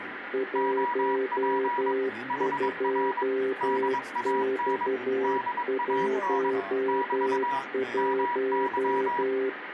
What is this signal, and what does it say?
Morse code, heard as two keyed tones, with radio static and speech in English. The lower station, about 12 wpm, 390 Hz: 12X11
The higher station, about 22 wpm, 970 Hz: OP HR DAN DAN <BT> MY